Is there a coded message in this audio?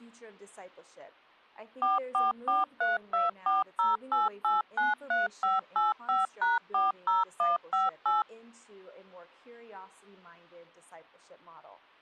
Yes: DTMF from 1.8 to 8.2 s, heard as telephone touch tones, dialled by machine, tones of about 160 ms. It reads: 44432408893585#40158